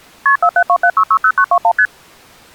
Multi-frequency trunk signalling (R1, as on North American trunks), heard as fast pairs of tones, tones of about 70 ms. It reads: KP 4727660921 ST